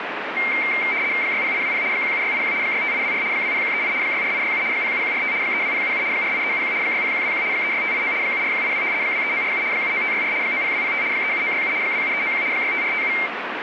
RTTY (75 baud, 170 Hz shift), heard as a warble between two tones, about 2200 Hz centre, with radio static. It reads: 60820 17681 65824 20138 64867 07145 32077 48371 60121 36589 74182 23947 79564 90205 37967 27391 65457